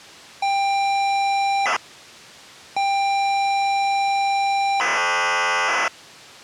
ZX Spectrum tape loading, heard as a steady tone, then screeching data.